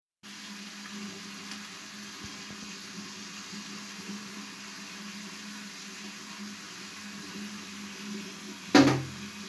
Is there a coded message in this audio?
No, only the noise of a restroom.